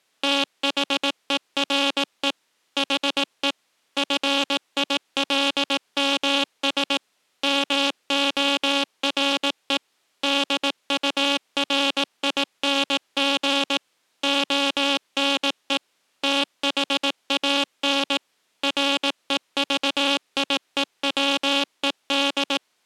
Morse code, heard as a buzzer, machine-sent, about 18 wpm. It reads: THERE HE FILMS MORE DURING ONE THAN REVIEWED